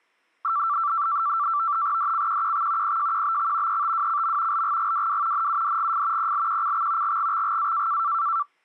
NAVTEX (SITOR-B), 100 baud, 170 Hz shift, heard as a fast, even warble, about 1250 Hz centre. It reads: DCQQX PJQBX ETWCM LGGWW NUDGF PLQCX GGXGA